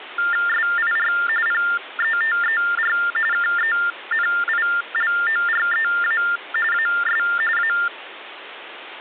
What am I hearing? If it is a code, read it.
TTY/TDD text telephone tones (45.45 baud Baudot), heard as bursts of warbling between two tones, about 400 Hz shift, 1600 Hz centre, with phone line noise. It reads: SIR PETER KENILOREA AS A